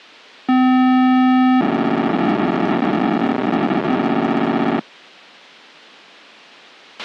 POCSAG pager data (512 baud), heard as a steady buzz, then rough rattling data, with a squelch burst at the end.